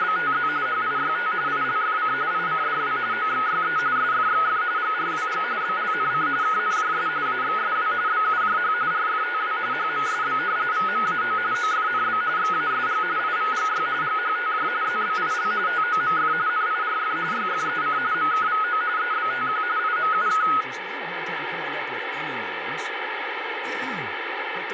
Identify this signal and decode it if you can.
RTTY (45.45 baud, 170 Hz shift), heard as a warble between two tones, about 1360 Hz centre, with radio static. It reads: … HIYT ILFC ICDW OXYE SFXF GRWG BLNC KNJS AXSW BUJH RFTW HMSB VMAO OFNB XASG IVGY GHTJ ZBIL TOMF NIRF YFEC MKVO EBTQ IMUK